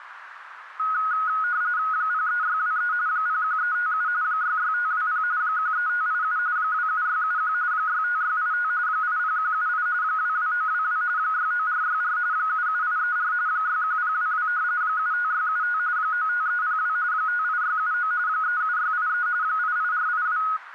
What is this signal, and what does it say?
RTTY (45.45 baud, 170 Hz shift), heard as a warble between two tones, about 1360 Hz centre, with radio static and a narrow filter. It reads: 03623 01357 66520 13587 27671 65685 80178 22922 69464 77834 61022 75675 95302 58679 37683 88482